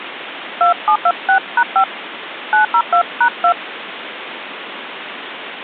DTMF, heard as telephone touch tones, dialled by hand, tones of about 90 ms, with phone line noise. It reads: 2726#5 902#2